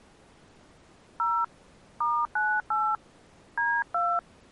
DTMF, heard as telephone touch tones, dialled by hand, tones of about 250 ms. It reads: 0 *98 D2